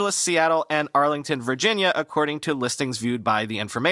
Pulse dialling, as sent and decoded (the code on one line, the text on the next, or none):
none